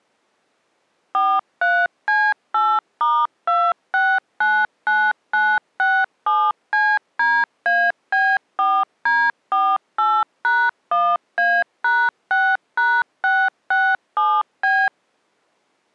DTMF, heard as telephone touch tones, dialled by machine, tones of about 240 ms. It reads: 43C8*2699967CDAB4D48#1A#6#667B